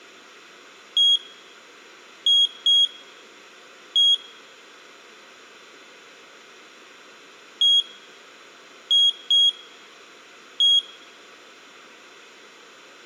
Beep code, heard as a piezo beeper, played twice, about 3300 Hz, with room echo. 1-2-1. In Phoenix BIOS tables: interval timer failure.